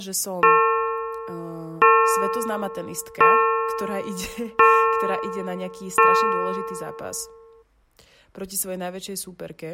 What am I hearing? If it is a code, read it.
Clock strike, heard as a bell, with speech in Slovak. 5. Five o'clock.